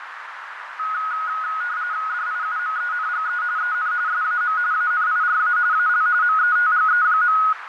RTTY (45.45 baud, 170 Hz shift), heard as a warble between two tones, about 1360 Hz centre, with radio static, fading and a narrow filter. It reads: DIUMENGE EN SAM ANIRA AL METGE.